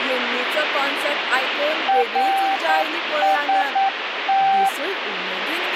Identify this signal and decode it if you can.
Morse code, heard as a keyed tone, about 9 wpm, 780 Hz, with radio static and speech in Goan Konkani. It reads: RST